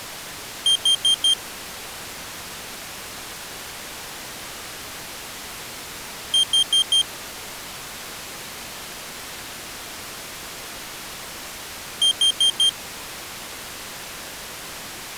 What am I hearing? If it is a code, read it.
Alarm pattern, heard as an alarm's beeps, played three times, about 3200 Hz. Temporal four. Carbon monoxide.